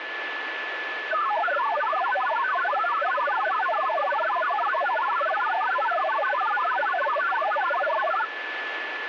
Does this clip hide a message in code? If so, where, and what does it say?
Yes: multi-tone FSK (Olivia or MFSK type), about 1000 Hz wide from 1.1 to 8.3 s, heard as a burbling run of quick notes, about 62.5 baud, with radio static and a steady whistle near 1730 Hz.